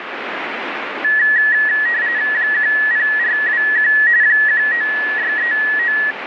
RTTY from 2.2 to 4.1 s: 10421

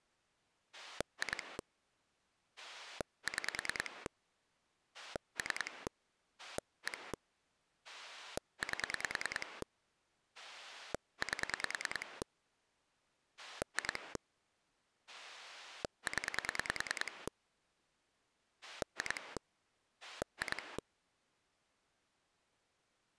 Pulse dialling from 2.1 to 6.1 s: 6 3

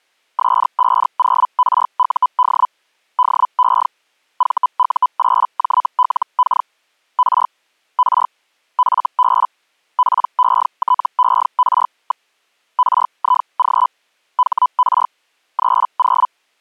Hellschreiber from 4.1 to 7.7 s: VU8JLK R

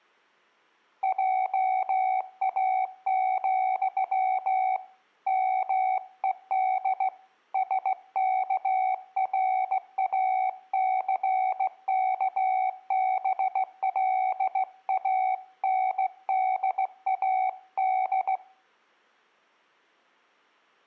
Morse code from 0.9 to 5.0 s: JA,

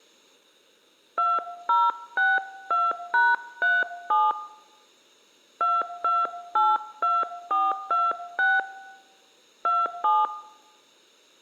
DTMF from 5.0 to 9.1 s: 2282426

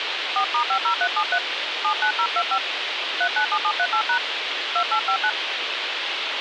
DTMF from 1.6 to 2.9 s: 79025

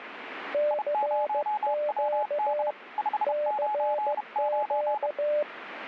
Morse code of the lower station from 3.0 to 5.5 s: CQ

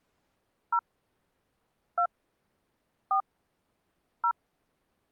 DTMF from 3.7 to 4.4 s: 0

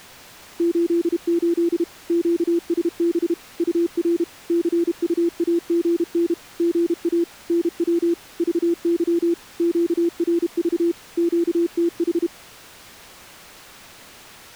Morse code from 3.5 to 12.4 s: UR CUAGN GA NW VY QRV QTH

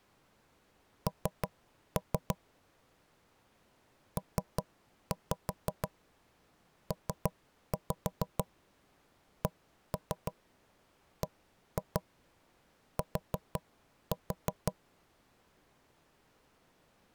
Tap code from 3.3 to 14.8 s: PPCBT

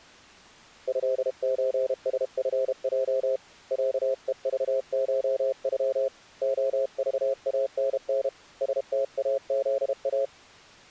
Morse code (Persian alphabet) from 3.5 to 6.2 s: صهذشغ

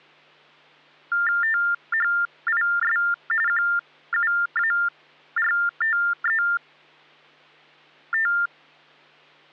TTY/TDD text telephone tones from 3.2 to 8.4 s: QUARTET

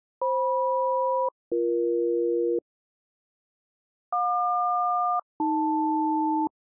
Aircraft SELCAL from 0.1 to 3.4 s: FM-BE

